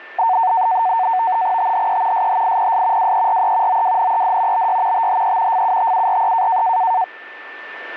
NAVTEX (SITOR-B), 100 baud, 170 Hz shift, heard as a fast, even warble, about 830 Hz centre, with a steady whistle near 1780 Hz. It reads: THE SHIPS WERE OWNED BY THE FUTURE